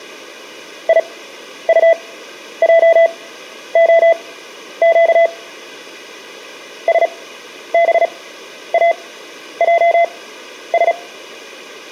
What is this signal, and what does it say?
Morse code, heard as a keyed tone, machine-sent, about 36 wpm, spaced as for 11 wpm, 670 Hz, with room echo. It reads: IUJOQ SBAJS